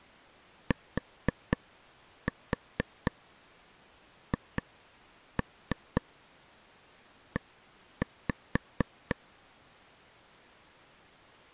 Tap code, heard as taps on a table, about 4 knocks a second. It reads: THE